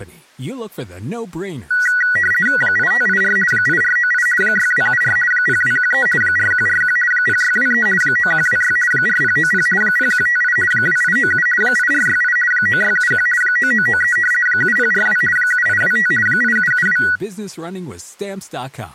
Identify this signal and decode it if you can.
RTTY (50 baud, 450 Hz shift), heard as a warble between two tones, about 1700 Hz centre, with speech in French. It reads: 8584 8498 6274 0213 4141 0623 9126 4090 0158 2897 8468 9671 9993 7042 7825 8772